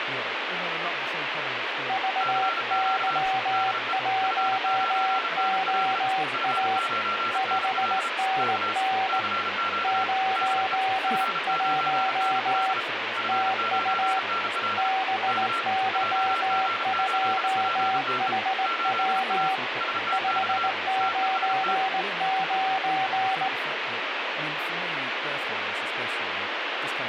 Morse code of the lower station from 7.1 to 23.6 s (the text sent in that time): 5NN 01 TU BY2HW 599